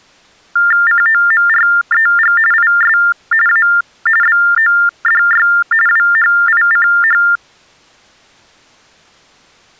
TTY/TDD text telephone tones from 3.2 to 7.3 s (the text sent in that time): A BODY WHICH